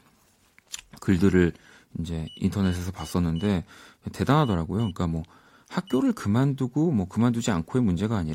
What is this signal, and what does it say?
Beep code, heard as a piezo beeper, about 2950 Hz, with speech in Korean. 4-2-1. In Phoenix BIOS tables: timer tick failure.